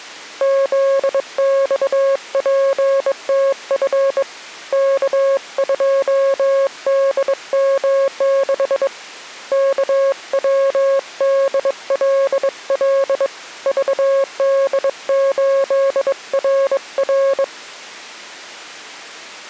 Morse code, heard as a keyed tone, hand-sent with a bug key, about 22 wpm, 550 Hz. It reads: ZXPTF K2DM6 KWDLL VD8RR